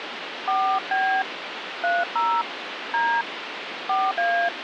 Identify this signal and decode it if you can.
DTMF, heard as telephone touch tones, dialled by hand, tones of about 220 ms, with phone line noise. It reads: 4B 30 D 4A